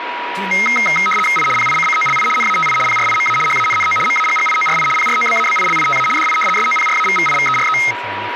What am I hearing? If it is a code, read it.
RTTY (75 baud, 850 Hz shift), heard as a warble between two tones, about 1700 Hz centre, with radio static, a steady whistle near 970 Hz and speech in Bodo. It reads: I PICCOLI NATI PRIMA HANNO MAGGIORI PROBABILITA DI SOPRAVVIVERE